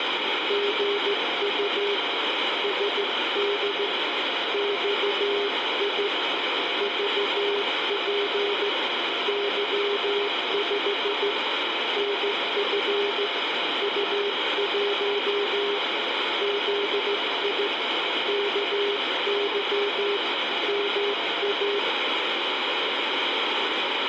Morse code, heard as two keyed tones, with heavy radio static. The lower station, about 15 wpm, 410 Hz: GU SD XI VP Y5 NF U1 ZI KY MA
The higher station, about 22 wpm, 700 Hz: ANT IS HEX BEAM UP 21M - WX IS OVERCAST TEMP